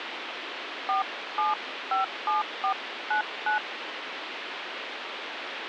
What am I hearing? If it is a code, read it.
DTMF, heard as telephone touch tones, dialled by hand, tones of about 150 ms, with phone line noise. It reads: 4757499